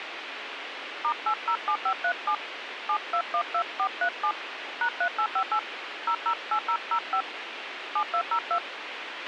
DTMF, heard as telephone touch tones, dialled by hand, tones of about 80 ms, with radio hiss and a squelch burst at the end. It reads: *807537 7212437 #3858 008005 7202